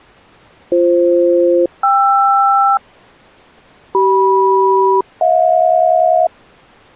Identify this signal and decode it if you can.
Aircraft SELCAL, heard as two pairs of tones. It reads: BF-KR CM-HJ